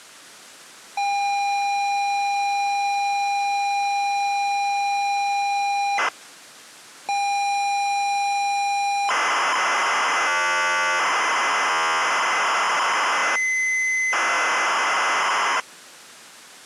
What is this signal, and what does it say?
ZX Spectrum tape loading, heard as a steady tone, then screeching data.